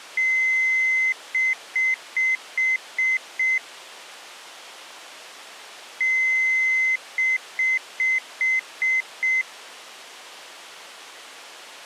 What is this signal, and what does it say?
Beep code, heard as beeps, played twice, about 2050 Hz. 1 long, 6 short.